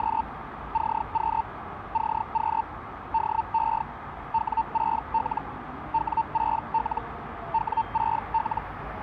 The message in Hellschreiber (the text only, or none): … CQ CQ DE W6L W6L W6L